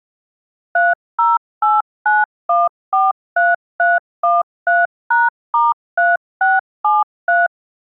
DTMF, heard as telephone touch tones, dialled by machine, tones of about 190 ms. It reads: 3089143313#*3673